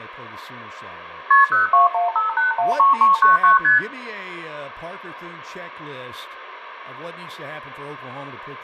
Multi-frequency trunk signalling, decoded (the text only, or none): KP 0215813399 ST